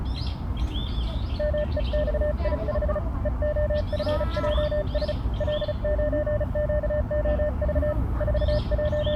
Morse code, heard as a keyed tone, hand-sent with a paddle, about 35 wpm, 600 Hz, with the noise of a park. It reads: MEXI5 EOFJS L9QOV …